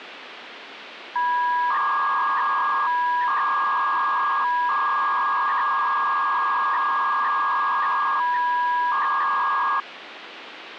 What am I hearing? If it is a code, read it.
300-baud modem data (V.21 tones), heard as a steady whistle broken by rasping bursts, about 300 baud, 200 Hz shift, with phone line noise.